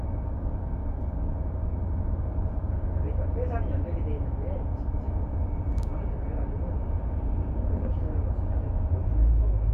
The noise inside a bus. There is no code.